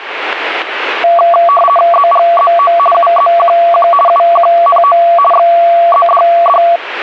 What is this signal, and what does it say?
RTTY (50 baud, 450 Hz shift), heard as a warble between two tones, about 910 Hz centre, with radio static. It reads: ZGZO UZQQ UQNO XZDD